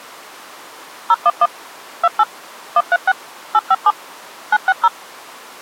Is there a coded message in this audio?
Yes: DTMF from 1.1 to 4.9 s, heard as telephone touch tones, dialled by machine, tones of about 40 ms. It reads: 011 28 136 857 960